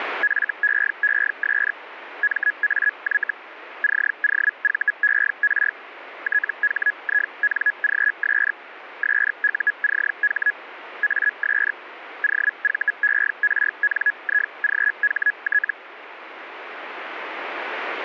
Hellschreiber (Feld-Hell, 122.5 baud), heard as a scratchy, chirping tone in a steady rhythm, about 1700 Hz, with radio static. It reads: FEES MAY COVER THINGS SUCH AS OVERNIGHT